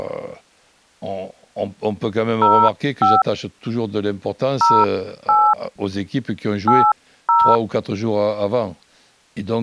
DTMF, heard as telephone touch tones, dialled by hand, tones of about 230 ms, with speech in French. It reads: 05 08 80